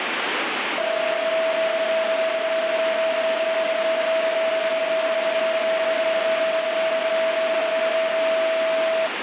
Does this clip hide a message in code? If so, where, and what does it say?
Yes: PSK31 (31.25 baud) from 0.8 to 9.1 s, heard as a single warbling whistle, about 650 Hz, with radio static.